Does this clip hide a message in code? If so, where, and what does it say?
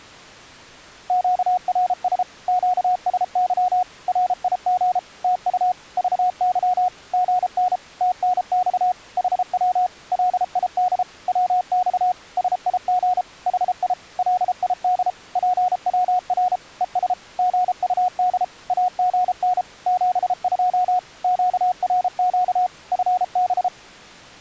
Yes: Morse code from 1.0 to 23.7 s, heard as a keyed tone, machine-sent, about 33 wpm, 730 Hz. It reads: QRS QSY RIG TU VY GN TNX HW LID WX SIG HI LID PWR ES GUD AGN 72 QRQ FB